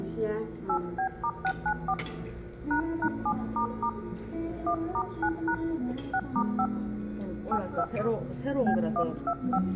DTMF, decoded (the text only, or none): 8B*694 ##7** 1*9# 6*5 82 B125